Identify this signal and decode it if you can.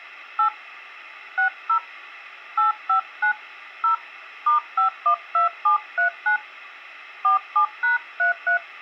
DTMF, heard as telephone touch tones, dialled by hand, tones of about 110 ms. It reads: 8 60 859 0 *512739 47#33